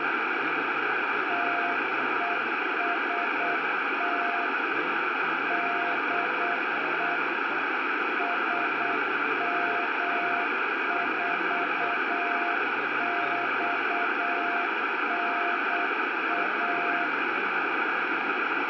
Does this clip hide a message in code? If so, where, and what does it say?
Yes: Morse code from 1.2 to 17.1 s, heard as a keyed tone, machine-sent, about 8 wpm, 700 Hz, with heavy radio static. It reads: TEST DE SM4XNA